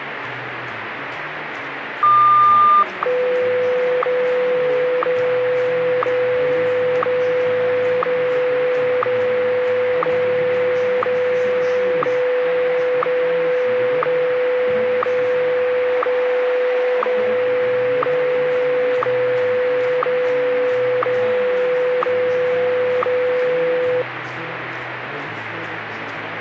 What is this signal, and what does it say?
Radio time signal (WWVH, Hawaii), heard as ticks, one a second, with radio static.